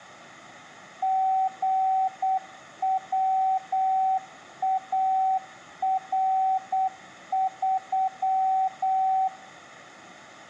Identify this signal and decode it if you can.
Morse code, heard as a keyed tone, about 8 wpm, 760 Hz, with room echo. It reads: GWAR3